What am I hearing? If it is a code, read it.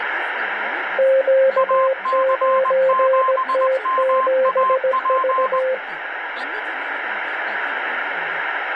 Morse code, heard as two keyed tones, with radio static and speech in Telugu. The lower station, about 17 wpm, 530 Hz: Q9T7V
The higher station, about 20 wpm, 1050 Hz: AC7MAP